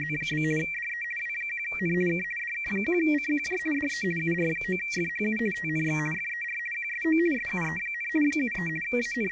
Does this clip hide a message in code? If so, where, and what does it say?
Yes: RTTY (50 baud, 450 Hz shift) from 0.0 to 9.3 s, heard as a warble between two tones, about 2100 Hz centre. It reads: … DE W1N K DK1CQJ DE UR9FHU TNX FER QSO SUE, 73 …